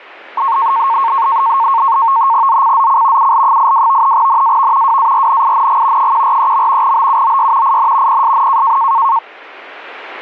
NAVTEX (SITOR-B), 100 baud, 170 Hz shift, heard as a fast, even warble, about 1000 Hz centre. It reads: ZCZC UL82 NAV WARNING 143. BUOY IN PSN